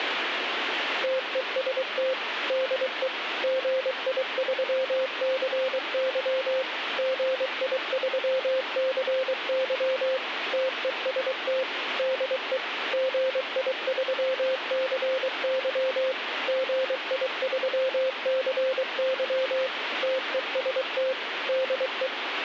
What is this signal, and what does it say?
Morse code, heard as a keyed tone, machine-sent, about 23 wpm, 520 Hz, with radio static. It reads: TEST DE GI3CY GI3CY TEST DE GI3CY GI3CY TEST DE